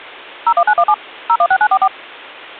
DTMF, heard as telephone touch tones, dialled by machine, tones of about 60 ms. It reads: 01917 016944